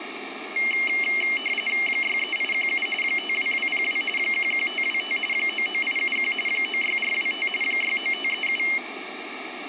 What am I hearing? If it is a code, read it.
RTTY (45.45 baud, 850 Hz shift), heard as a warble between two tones, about 2550 Hz centre, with radio static. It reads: 63817 52202 11525 99871 96425 69537